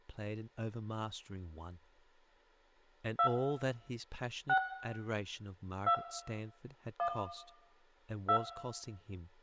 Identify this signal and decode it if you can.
DTMF, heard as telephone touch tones, dialled by hand, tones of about 80 ms, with room echo and speech in English. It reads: 2 6 2 1 2